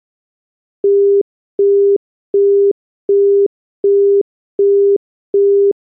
Telephone call progress tone (as in the UK, Australia and similar networks), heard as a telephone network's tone, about 400 Hz, 0.375 s on and 0.375 s off. Busy tone.